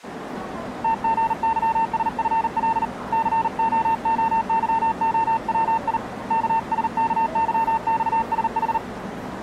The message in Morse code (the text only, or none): TGYSFL COOYOWI KSKYXSH